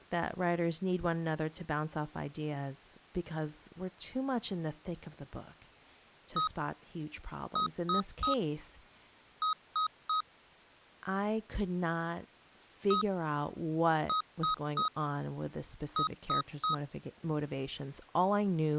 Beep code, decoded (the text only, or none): 1-3-3